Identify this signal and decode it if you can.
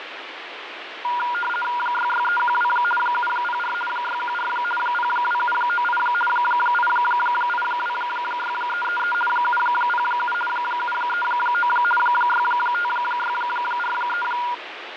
RTTY (50 baud, 450 Hz shift), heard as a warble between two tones, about 1200 Hz centre, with radio static and fading. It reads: 66312 704 614 02798 8826333 707 739 65643